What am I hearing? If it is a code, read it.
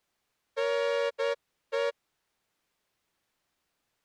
Morse code (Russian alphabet), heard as a horn, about 9 wpm. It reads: НЕ